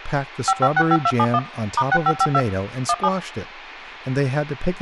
DTMF, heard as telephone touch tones, dialled by machine, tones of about 50 ms, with room echo and speech in English. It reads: 5565271 *6552 17